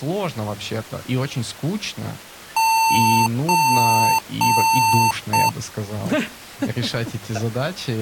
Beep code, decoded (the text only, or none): 3 long, 1 short